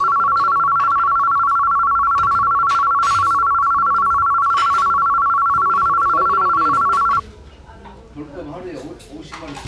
A tone that alternates evenly between two pitches, with the noise of a restaurant. There is no code.